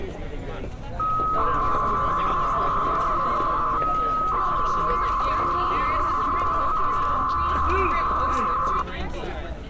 300-baud modem data (Bell 103 tones), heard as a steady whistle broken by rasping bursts, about 300 baud, 200 Hz shift, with street noise.